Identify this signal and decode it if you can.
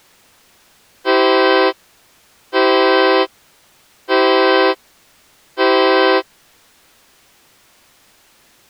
Train horn signal, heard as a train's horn. 4 short. On North American railways: a request for a signal to be given or repeated.